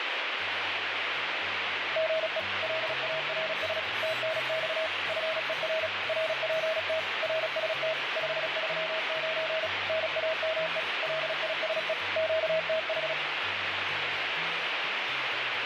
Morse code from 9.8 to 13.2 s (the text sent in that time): NAME LISE QTH